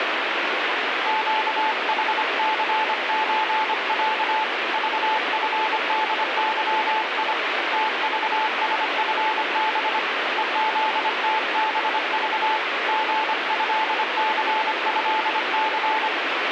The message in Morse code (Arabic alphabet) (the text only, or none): قحثزع ضفدظي تضسفب ءذتبض غهثهث